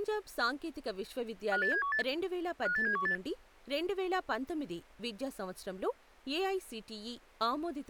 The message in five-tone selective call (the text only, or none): 58718 58718